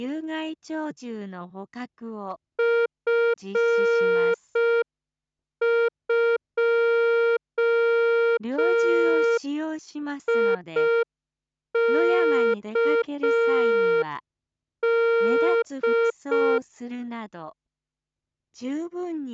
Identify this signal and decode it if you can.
Morse code, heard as a keyed tone, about 5 wpm, 460 Hz. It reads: F2IKD